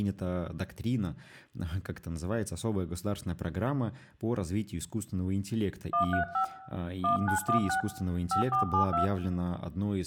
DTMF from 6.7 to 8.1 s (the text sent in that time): 1916